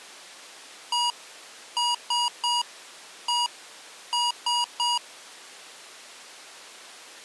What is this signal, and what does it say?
Beep code, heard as beeps from a small speaker, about 960 Hz. 1-3-1-3. In Phoenix BIOS tables: keyboard controller test failure.